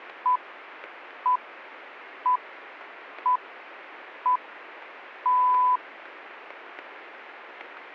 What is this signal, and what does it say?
Radio time signal (six pips, as the Greenwich Time Signal), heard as pips.